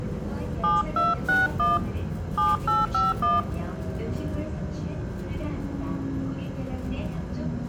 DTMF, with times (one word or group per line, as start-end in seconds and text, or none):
0.6-1.8 7261
2.4-3.4 7851